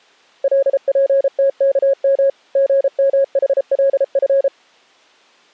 Morse code (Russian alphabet), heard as a keyed tone, machine-sent, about 33 wpm, 550 Hz. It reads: ЛПТКМ ГМХЛФ